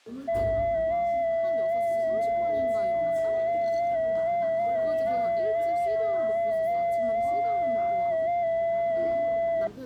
FT8 (one signal), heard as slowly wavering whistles, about 6.25 baud, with the noise of a cafe.